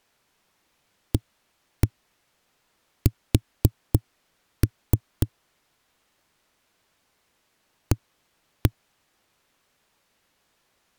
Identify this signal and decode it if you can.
Tap code, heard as knocks on a wall, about 3 knocks a second. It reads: AS A